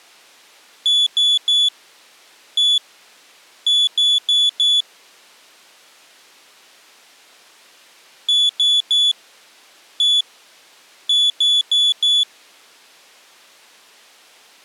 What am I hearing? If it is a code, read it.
Beep code, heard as a piezo beeper, played twice, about 3450 Hz. 3-1-4. In Phoenix BIOS tables: interrupt mask register failure.